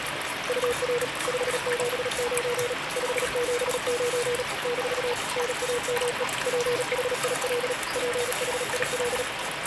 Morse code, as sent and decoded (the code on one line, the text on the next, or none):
..- .-. / ..... --... ----. / ..... --... ----. / -....- / -. .- -- . / .--. .... .. .-.. / .--. .... .. .-..
UR 579 579 - NAME PHIL PHIL